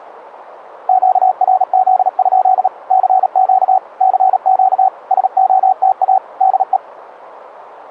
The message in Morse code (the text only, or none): QRZ? CQ CQ SOTA DE